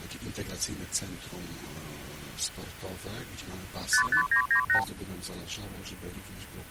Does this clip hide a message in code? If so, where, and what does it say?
Yes: multi-frequency trunk signalling (R2, with the far end's replies) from 3.9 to 4.8 s, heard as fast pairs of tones, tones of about 100 ms. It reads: 55998